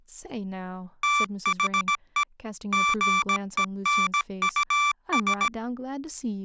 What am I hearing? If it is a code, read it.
Morse code, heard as electronic beeps, machine-sent, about 17 wpm, 1170 Hz, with speech in English. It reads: THE GENUS